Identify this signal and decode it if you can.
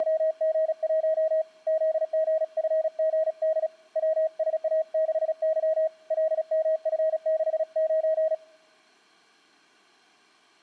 Morse code, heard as a keyed tone, hand-sent with a paddle, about 36 wpm, 630 Hz. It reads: … ZGFGD WSA6Y LMF69